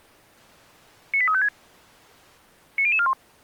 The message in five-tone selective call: 98356 90041

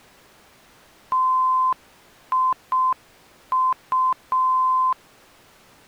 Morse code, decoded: TIU

